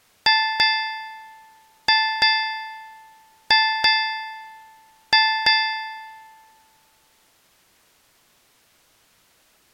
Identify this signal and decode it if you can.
Ship's bell, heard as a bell. 8. Eight half-hours of the watch have passed.